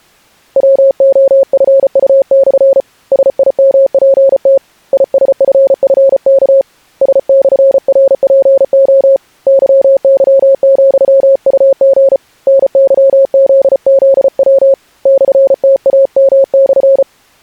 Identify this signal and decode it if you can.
Morse code, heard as a keyed tone, hand-sent with a paddle, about 34 wpm, 540 Hz. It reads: WOFU/ SIMPT ISFFK S/RPO YY,UG NYZZW /TAM/